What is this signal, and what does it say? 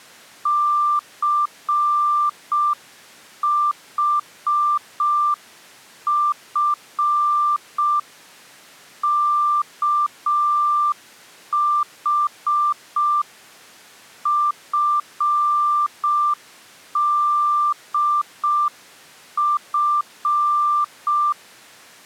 Morse code (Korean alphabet), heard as a keyed tone, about 5 wpm, 1180 Hz. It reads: 춘우는